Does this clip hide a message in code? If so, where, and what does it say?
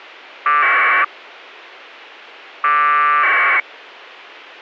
Yes: packet radio (AX.25, as in APRS), 1200 baud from 0.5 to 3.6 s, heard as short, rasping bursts.